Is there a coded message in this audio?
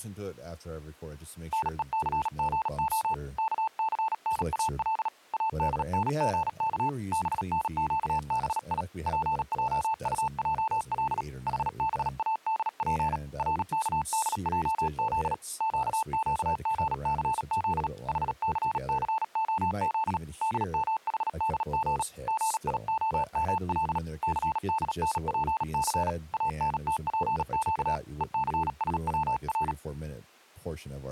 Yes: Morse code (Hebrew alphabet) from 1.5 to 29.8 s, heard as a keyed tone, hand-sent with a paddle, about 37 wpm, 880 Hz, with speech in English. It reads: נוסגה כסנאל אדנגך בנקבי פעטעל חבאדף רכדעז קקגסז חססהז דמחדג גיהמל סדנפס אנתפק וסשצר